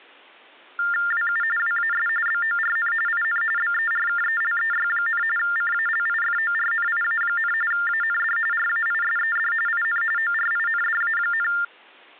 TTY/TDD text telephone tones (45.45 baud Baudot), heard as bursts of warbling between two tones, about 400 Hz shift, 1600 Hz centre. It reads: WU WAS BORN IN BERKELEY, CALIFORNIA, AND RAISED IN ORINDA,